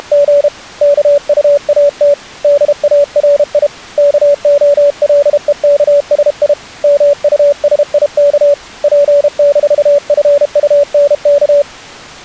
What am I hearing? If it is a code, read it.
Morse code, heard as a keyed tone, hand-sent with a paddle, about 32 wpm, 570 Hz. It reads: … KUAT DARI KOLEKSI MUSIK P-FUNK